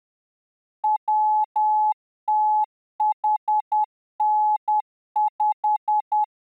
Morse code, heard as a keyed tone, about 10 wpm, 850 Hz. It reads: WTHN5